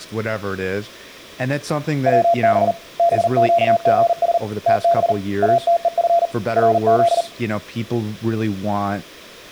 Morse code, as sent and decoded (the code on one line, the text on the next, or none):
.-- -... / -... --.- --. ... / - -... / .- - . ..-. / .-. --..
WB BQGS TB ATEF RZ